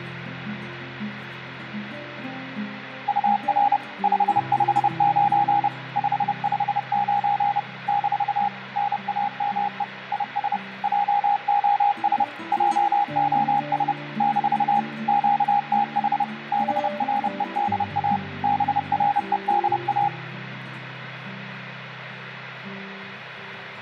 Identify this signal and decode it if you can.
Morse code, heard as a keyed tone, machine-sent, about 30 wpm, 820 Hz, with radio static and room echo. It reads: UR 559 559 - NAME IS JOS JOS - QTH BREDA BREDA